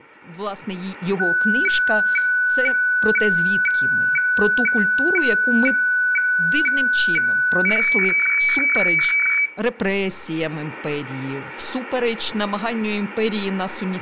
Weather fax (radiofax), 120 lines a minute, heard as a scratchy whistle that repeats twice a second, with room echo and speech in Ukrainian.